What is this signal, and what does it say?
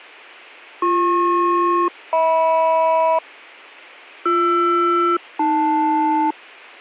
Aircraft SELCAL, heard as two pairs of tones. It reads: BP-HM BR-AL